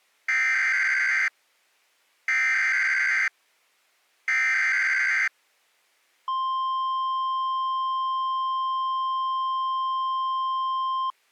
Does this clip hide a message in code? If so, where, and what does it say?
Yes: Emergency Alert System (SAME) tones (header bursts, then the 1050 Hz attention tone) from 0.3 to 11.1 s, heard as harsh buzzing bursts, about 520.83 baud.